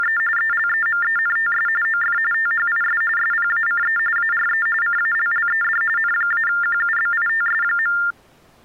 TTY/TDD text telephone tones (45.45 baud Baudot), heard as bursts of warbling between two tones, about 400 Hz shift, 1600 Hz centre. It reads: … ELEMENTS OF THIS SPACE ARE CALLED N-QUBITS.